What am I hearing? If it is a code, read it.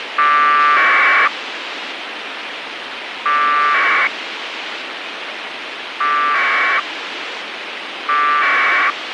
Packet radio (AX.25, as in APRS), 1200 baud, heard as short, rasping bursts, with radio hiss and a squelch burst at the end.